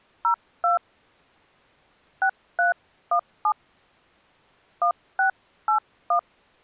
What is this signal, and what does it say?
DTMF, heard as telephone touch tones, dialled by hand, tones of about 100 ms. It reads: 02 6317 1681